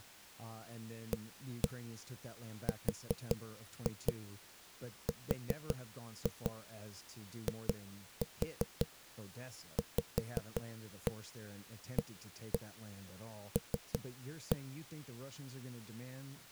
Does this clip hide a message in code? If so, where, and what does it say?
Yes: tap code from 1.1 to 14.6 s, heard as knocks on a wall, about 5 knocks a second, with speech in English. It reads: ARRIVAL